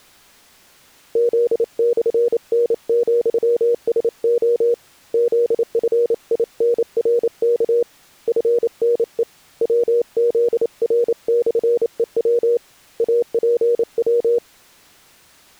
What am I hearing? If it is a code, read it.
Morse code, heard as a keyed tone, hand-sent with a paddle, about 28 wpm, 480 Hz. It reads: Z/N,SO ZFINRK FNE WZR/EW APW